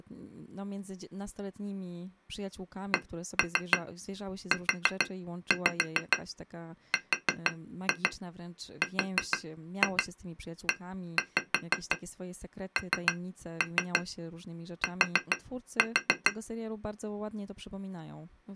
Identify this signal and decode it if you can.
Tap code, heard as taps on glass, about 6 knocks a second, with speech in Polish. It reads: CURRENT